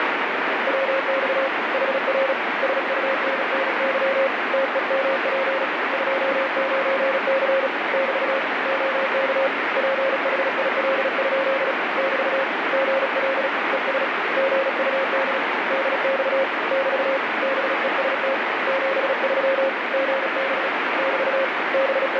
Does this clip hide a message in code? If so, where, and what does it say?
Yes: Morse code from 0.6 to 22.2 s, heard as a keyed tone, hand-sent with a paddle, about 36 wpm, 540 Hz, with heavy radio static. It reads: WX HR SUNNY TEMP 29C <BT> OK PHIL? <BT> GL ES GUD DX <BT> BEST 73 GB <BT> …